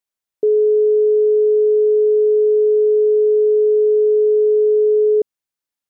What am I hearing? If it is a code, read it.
Telephone call progress tone (425 Hz plan, as in most of Europe), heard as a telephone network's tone, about 420 Hz. Dial tone.